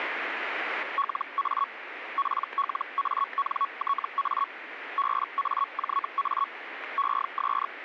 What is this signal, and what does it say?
Hellschreiber (Feld-Hell, 122.5 baud), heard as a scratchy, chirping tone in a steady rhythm, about 1110 Hz, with radio static. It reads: LA PLANTA BAJA ES